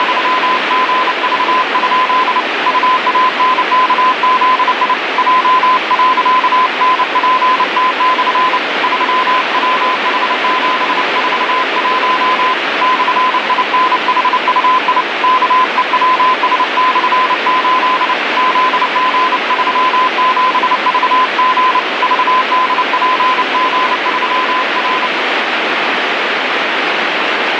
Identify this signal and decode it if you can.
Morse code, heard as a keyed tone, hand-sent with a paddle, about 29 wpm, 1020 Hz, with heavy radio static. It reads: … UANKZI J.NPT/ 3WH741 /INHUI KEWS/8 ZG37VG VDPG3R